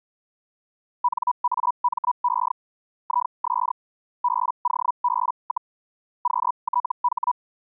Hellschreiber (Feld-Hell, 122.5 baud), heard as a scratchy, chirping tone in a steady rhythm, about 980 Hz. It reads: NAME IS BOB, QTH